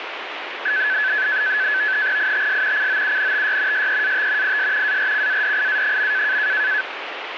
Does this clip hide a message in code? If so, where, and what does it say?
Yes: NAVTEX (SITOR-B), 100 baud, 170 Hz shift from 0.7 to 6.8 s, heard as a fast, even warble, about 1600 Hz centre, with radio static. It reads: ITS COUNTY SEAT IS ARCADIA.